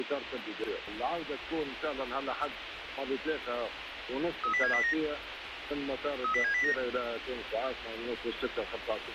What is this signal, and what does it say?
Five-tone selective call (CCIR), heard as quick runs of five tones, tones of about 100 ms, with radio hiss. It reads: 30709 30709